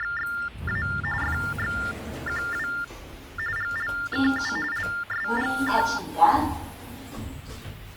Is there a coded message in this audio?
Yes: TTY/TDD text telephone tones (45.45 baud Baudot) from 0.0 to 6.0 s, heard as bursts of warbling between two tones, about 400 Hz shift, 1600 Hz centre, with the noise inside a lift. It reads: … FXQW GLKU LSGK